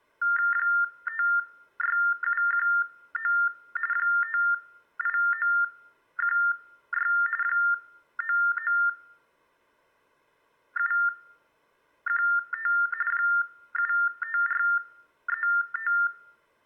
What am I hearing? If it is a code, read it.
TTY/TDD text telephone tones (45.45 baud Baudot), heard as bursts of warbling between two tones, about 400 Hz shift, 1600 Hz centre. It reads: 56719 58916 99715 75435